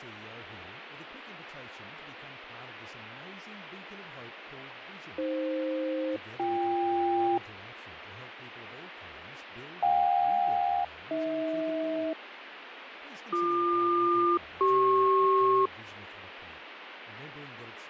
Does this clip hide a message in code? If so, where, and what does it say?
Yes: aircraft SELCAL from 5.2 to 15.7 s, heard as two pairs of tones, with radio static and speech in English. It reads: AF-BK JK-AH BQ-CP